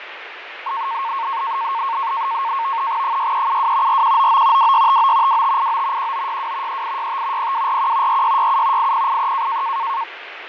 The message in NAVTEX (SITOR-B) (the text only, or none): 6372 4199 2659 2589 1962 3865 0241 4667 8083